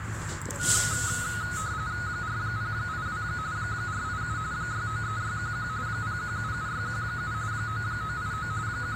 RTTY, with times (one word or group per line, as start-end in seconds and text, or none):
2.1-3.2 4082
3.6-4.4 487
4.5-5.7 693611
5.9-7.3 0177617
7.5-8.5 9989
8.7-9.0 …